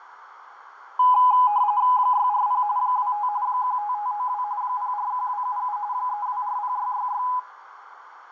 RTTY (45.45 baud, 170 Hz shift), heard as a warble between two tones, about 920 Hz centre, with radio static, fading and a narrow filter. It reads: 640 25 15592 041277 3240666